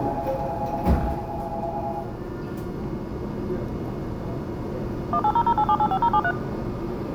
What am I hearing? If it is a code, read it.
DTMF, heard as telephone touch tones, dialled by machine, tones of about 60 ms, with the noise inside a subway train. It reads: 18008785073